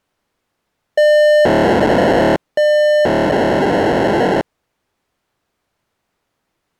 POCSAG pager data (1200 baud), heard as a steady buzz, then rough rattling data.